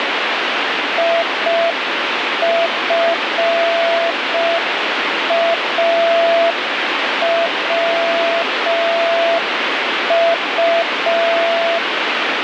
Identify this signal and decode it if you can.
Morse code, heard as a keyed tone, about 5 wpm, 670 Hz, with radio static. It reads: IFAWU